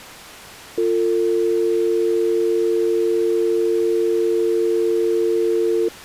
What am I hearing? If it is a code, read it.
Telephone call progress tone (North American or UK plan), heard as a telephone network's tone, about 350, 450 Hz. Dial tone.